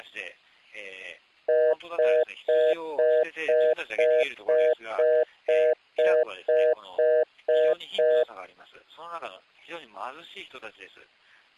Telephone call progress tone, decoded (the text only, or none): congestion tone